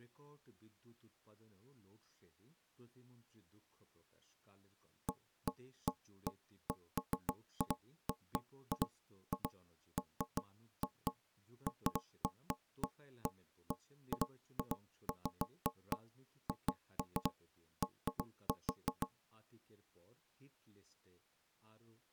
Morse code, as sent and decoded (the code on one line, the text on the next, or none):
none